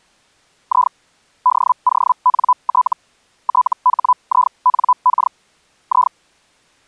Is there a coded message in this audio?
Yes: Hellschreiber (Feld-Hell, 122.5 baud) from 0.7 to 6.1 s, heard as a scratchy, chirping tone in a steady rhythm, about 1000 Hz. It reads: I DONT THINK I